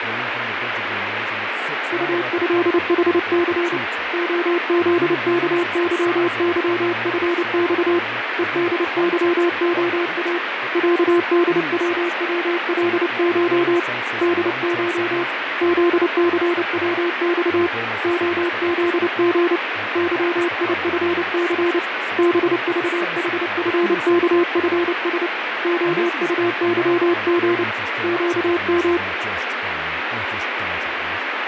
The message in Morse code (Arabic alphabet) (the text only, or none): طهحث خذكظظفص ءدظخا عدوولش دش ذثوص خذغ ظيفث بضحفكفس خطظغ قم